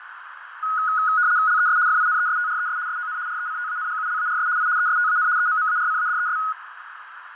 RTTY (75 baud, 170 Hz shift), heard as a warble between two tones, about 1360 Hz centre, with radio static, fading and a narrow filter. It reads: LES FINESTRES SON RECTANGULARS I ESTAN EMMARCADES